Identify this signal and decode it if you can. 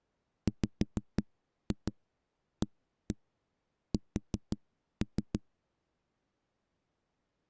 Tap code, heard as knocks on a wall, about 5 knocks a second. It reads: WAS